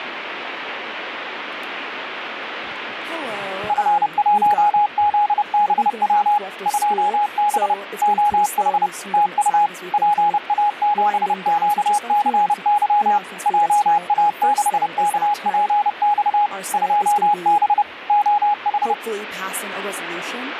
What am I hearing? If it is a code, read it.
Morse code, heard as a keyed tone, machine-sent, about 30 wpm, 830 Hz, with radio static. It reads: F1ZBW 2B OH TU PA7QCY JA6KPX 2B OH